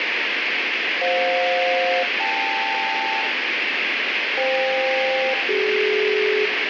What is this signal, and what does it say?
Aircraft SELCAL, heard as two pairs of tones, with radio static. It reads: FJ-KL FK-CD